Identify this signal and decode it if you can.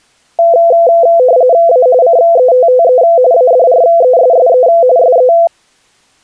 RTTY (45.45 baud, 170 Hz shift), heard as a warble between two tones, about 590 Hz centre. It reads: A CETTE ADRESSE SE